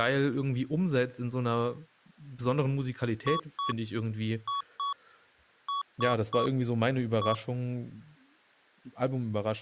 Beep code, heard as beeps from a small speaker, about 1120 Hz, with speech in German. 2-2-3-1. In Phoenix BIOS tables: unexpected interrupt.